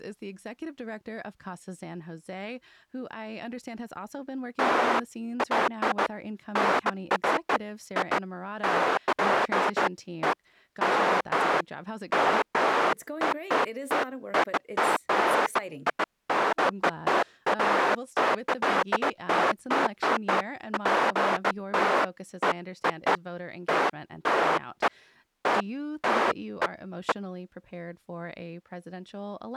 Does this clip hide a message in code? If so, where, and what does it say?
No, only bursts of noise, with speech in English.